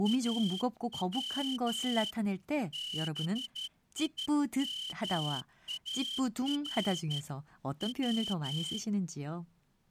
Morse code (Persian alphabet), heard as a whistle, hand-sent with a straight key, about 12 wpm, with speech in Korean. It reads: او بیمار و